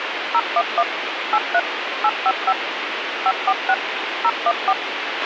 DTMF, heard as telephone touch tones, dialled by machine, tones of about 50 ms, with radio hiss and a squelch burst at the end. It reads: 011 83 855 546 014